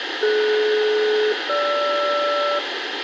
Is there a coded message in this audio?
Yes: aircraft SELCAL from 0.2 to 2.6 s, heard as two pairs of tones, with radio hiss. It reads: DS-GR